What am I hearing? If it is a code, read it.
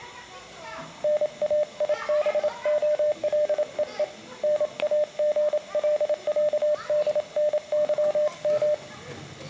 Morse code (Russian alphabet), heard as a keyed tone, hand-sent with a paddle, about 27 wpm, 600 Hz, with room echo and the noise of a park. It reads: НАИБОЛЕЕ НАГЛЯДНЫМ